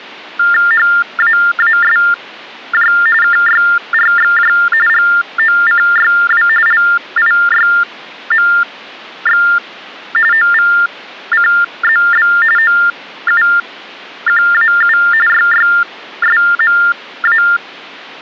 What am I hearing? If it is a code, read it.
TTY/TDD text telephone tones (45.45 baud Baudot), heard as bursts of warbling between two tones, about 400 Hz shift, 1600 Hz centre. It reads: HAASJ KYRXJ GOCYW LIYMX OVCZB OUQAU YYSMA